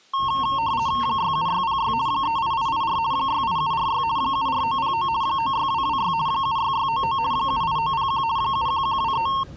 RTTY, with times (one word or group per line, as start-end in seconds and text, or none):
1.0-1.9 67606
2.1-3.0 38884
3.1-4.0 68746
4.2-5.1 74909
5.2-6.1 96226
6.3-7.2 76699
7.3-8.2 78901
8.4-9.3 71123